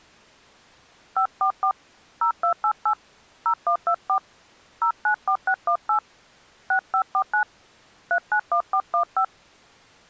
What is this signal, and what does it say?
DTMF, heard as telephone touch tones, dialled by hand, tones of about 80 ms. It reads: 544 0288 0124 094618 6549 391415